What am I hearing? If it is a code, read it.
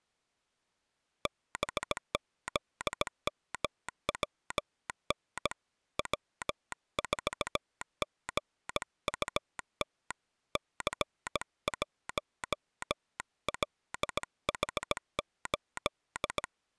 Morse code, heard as a telegraph sounder, hand-sent with a bug key, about 17 wpm. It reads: BZMWN W4GUT C1LH8